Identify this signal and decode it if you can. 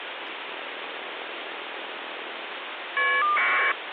Caller ID data burst, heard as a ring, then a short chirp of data, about 1200 baud, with phone line noise.